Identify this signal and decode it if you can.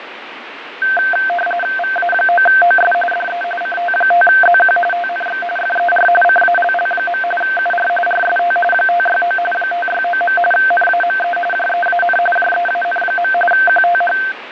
RTTY (45.45 baud, 850 Hz shift), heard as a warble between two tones, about 1120 Hz centre, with radio static and fading. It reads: VA9OS DE CT5ZQ TNX FER CALL. UR RST 569 569. NAME JEAN JEAN. QTH